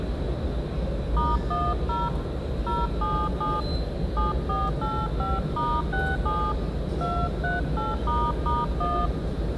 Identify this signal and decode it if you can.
DTMF, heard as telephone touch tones, dialled by hand, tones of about 210 ms, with the noise of a subway station. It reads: *10 077 7485*67 238**1